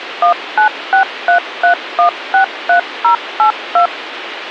DTMF, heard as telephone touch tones, dialled by machine, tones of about 100 ms, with radio hiss. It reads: 19633163082